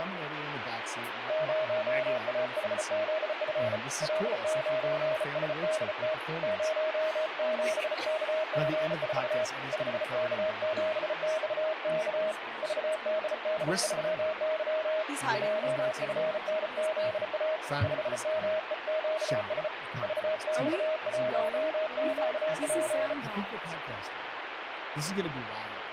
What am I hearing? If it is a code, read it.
Morse code, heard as a keyed tone, hand-sent with a bug key, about 34 wpm, 630 Hz, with radio static. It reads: 0AHZF L9SDT 07KG4 5K7XK VDD3Y JFNZA 5MEQS VX1QP